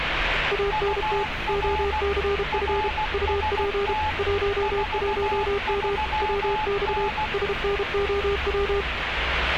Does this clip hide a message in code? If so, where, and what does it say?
Yes: Morse code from 0.5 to 8.9 s, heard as two keyed tones, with radio static and street noise. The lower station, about 32 wpm, 400 Hz: ANT OCF UP 11M WX SNOW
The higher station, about 16 wpm, 860 Hz: UR RST 43N